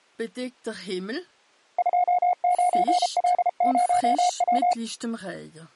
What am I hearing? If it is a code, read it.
Morse code, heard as a keyed tone, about 33 wpm, 720 Hz. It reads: 29L0W